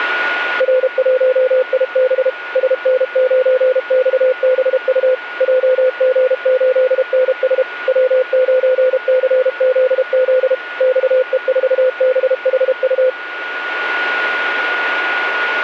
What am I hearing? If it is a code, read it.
Morse code, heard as a keyed tone, machine-sent, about 32 wpm, 510 Hz, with a steady whistle near 1450 Hz. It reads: R1IB SN9XBU JG8NS W9CZZ XE4BHU